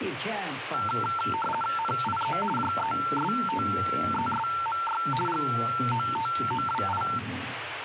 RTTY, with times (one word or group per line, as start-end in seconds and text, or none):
1.8-2.4 NIE
2.6-5.0 JESTESMY
5.3-7.0 GOTOWI